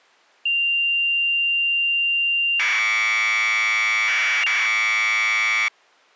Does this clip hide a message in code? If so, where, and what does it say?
Yes: Commodore tape loading (standard loader) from 0.5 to 5.7 s, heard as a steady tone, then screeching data.